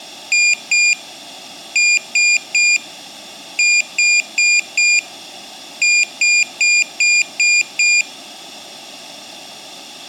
Beep code, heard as a piezo beeper, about 2400 Hz. 2-3-4-6.